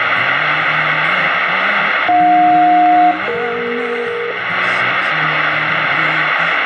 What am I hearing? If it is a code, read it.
Aircraft SELCAL, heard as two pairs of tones, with radio static and room echo. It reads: AJ-DE